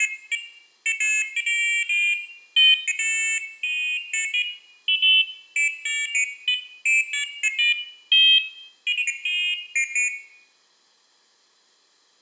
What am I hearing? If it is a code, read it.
Pairs of high tones at irregular times, with room echo. There is no code.